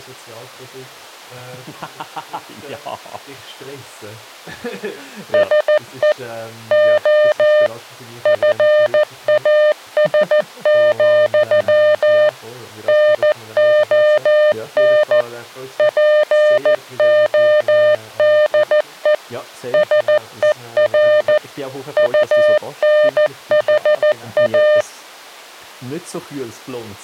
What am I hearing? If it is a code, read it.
Morse code, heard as a keyed tone, machine-sent, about 14 wpm, 600 Hz. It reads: SE O FAS, NON PODE SER UNHA